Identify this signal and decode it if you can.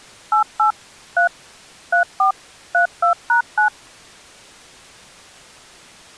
DTMF, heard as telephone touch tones, dialled by machine, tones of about 110 ms. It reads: 88 3 34 32#9